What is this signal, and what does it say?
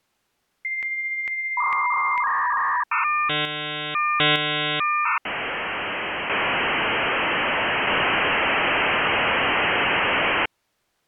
Dial-up modem handshake (V.34 or later), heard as a whistle, warbles, then hiss.